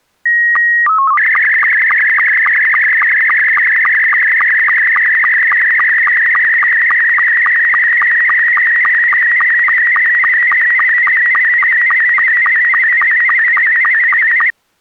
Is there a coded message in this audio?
Yes: SSTV (slow-scan television), Scottie S2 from 0.3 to 14.5 s, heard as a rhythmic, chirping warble.